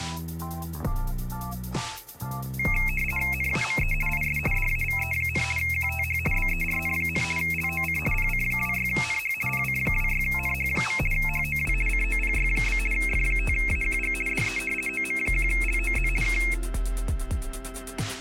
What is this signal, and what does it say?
RTTY (50 baud, 450 Hz shift), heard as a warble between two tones, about 2350 Hz centre. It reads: NAME IS DAVE, QTH BERN, LOC PC26NH PC26NH. HOW COPY? F5AQG DE OM1LOZ K